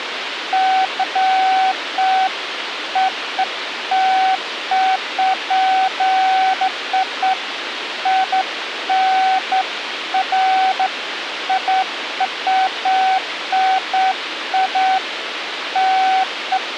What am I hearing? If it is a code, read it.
Beeps of irregular length, with radio hiss. There is no code.